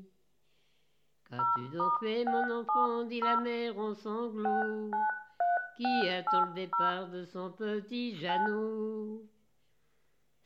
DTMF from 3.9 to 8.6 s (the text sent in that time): 693680 9